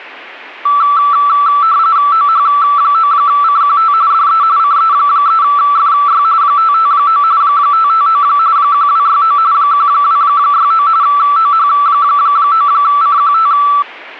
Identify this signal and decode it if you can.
RTTY (45.45 baud, 170 Hz shift), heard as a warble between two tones, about 1240 Hz centre. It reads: OH9CQT DE CE3FY 559 559 1269 1269 OH9CQT